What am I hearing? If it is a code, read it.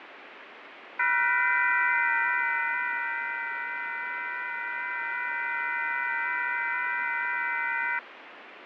FT8 (several signals at once), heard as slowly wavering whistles, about 6.25 baud, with radio static and fading.